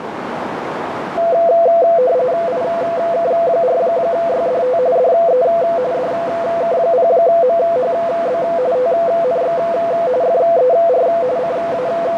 RTTY (45.45 baud, 170 Hz shift), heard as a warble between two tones, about 590 Hz centre, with radio static and a narrow filter. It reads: IK4YDT DE DK0MHB TNX FER …